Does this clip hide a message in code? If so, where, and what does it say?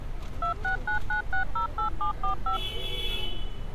Yes: DTMF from 0.4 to 2.6 s, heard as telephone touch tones, dialled by machine, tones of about 110 ms, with street noise. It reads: 2699608745